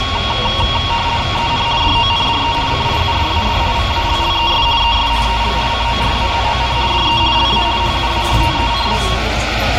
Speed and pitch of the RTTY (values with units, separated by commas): 50 baud, 170 Hz shift, 1020 Hz centre